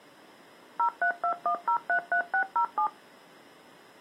DTMF, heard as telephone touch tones, dialled by machine, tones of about 90 ms. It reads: 0321033607